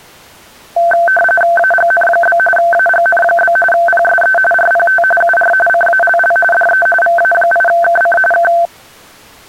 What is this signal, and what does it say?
RTTY (45.45 baud, 850 Hz shift), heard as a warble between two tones, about 1110 Hz centre. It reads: AGN? AGN? PSE RPT UR CALL DE VA8KC K